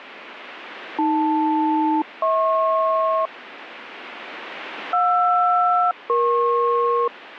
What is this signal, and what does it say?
Aircraft SELCAL, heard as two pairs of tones, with radio static. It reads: AL-HP JR-EP